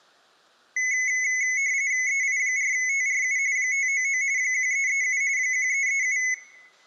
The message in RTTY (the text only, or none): EI4TRU 599 1337 1337